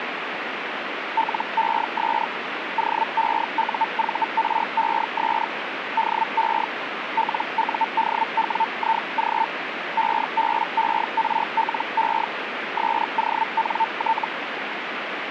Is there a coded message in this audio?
Yes: Hellschreiber (Feld-Hell, 122.5 baud) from 1.2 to 14.3 s, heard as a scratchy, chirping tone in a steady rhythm, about 900 Hz, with radio static. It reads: LES OEUVRES DE LUDWIG EBERLE SONT